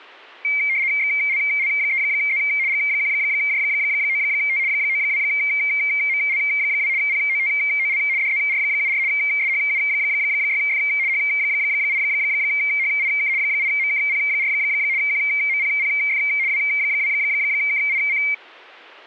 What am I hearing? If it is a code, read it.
RTTY (75 baud, 170 Hz shift), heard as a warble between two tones, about 2200 Hz centre. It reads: XLL3Z G1J9T 92ML2 POTOL DZR74 SHU6F H8HIK 8MKP4 QMPPF W2KIC